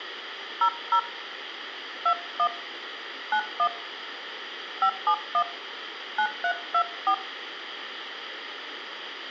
DTMF, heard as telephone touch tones, dialled by hand, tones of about 80 ms, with room echo. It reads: 00 21 91 571 9324